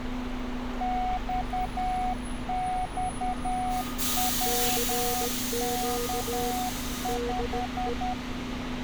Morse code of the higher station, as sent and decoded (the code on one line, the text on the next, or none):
-..- -..- .-- -.- .....
XXWK5